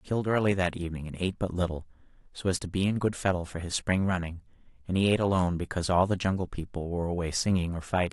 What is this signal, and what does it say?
Speech in English. There is no code.